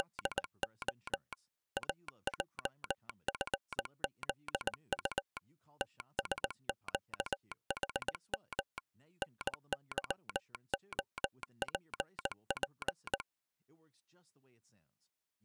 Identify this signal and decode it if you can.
Morse code, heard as a telegraph sounder, machine-sent, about 19 wpm, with speech in English. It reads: … AJFZU TSQHM NYOPP